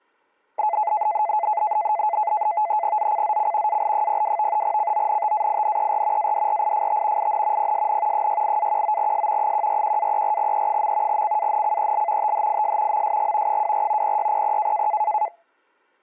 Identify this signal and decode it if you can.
NAVTEX (SITOR-B), 100 baud, 170 Hz shift, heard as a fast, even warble, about 770 Hz centre. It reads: ZCZC AL02 CONTAINER ADRIFT IN PSN 68-19S 141-34E. CANCEL THIS MSG 24 0600